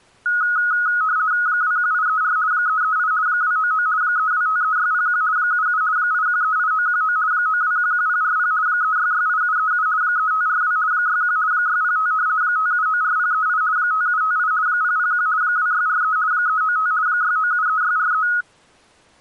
RTTY (50 baud, 170 Hz shift), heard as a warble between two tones, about 1360 Hz centre. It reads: 21834 338 299 3253601 77 8138919 9211040 3668737 3542 61 605 5794038 5758 001 2643 395 6973643